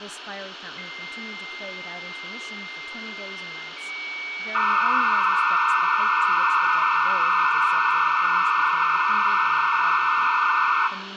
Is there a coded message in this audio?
Yes: dial-up modem handshake (low-speed, two carriers) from 0.8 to 10.9 s, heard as two whistles, then hiss, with phone line noise, room echo and speech in English.